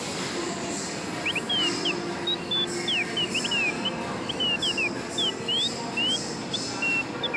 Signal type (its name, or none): none